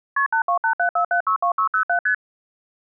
Multi-frequency trunk signalling (R1, as on North American trunks), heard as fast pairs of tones, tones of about 100 ms. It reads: KP 82874762607 ST